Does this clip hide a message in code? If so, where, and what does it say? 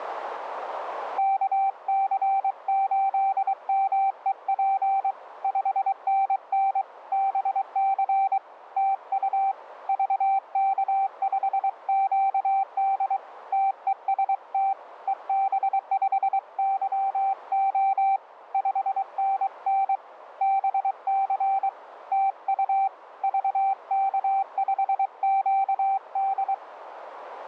Yes: Morse code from 1.1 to 26.6 s, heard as a keyed tone, hand-sent with a paddle, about 23 wpm, 780 Hz, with radio static. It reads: KC8MEP 5NN BC TU VK5QD TEST EB5YO 5NN BC TU VK5QD